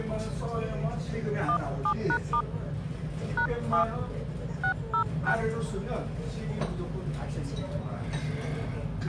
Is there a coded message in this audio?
Yes: DTMF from 1.5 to 5.3 s, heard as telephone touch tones, dialled by hand, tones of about 90 ms, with the noise of a restaurant. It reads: 17#* #7 606